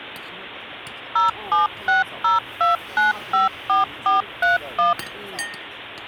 DTMF, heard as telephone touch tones, dialled by machine, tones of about 150 ms, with the noise of a restaurant. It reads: 07602954431